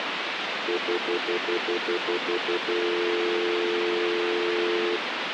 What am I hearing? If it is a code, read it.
Telephone call progress tone (North American plan), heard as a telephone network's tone, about 350, 440 Hz, 0.1 s on and 0.1 s off, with phone line noise. Stutter dial tone.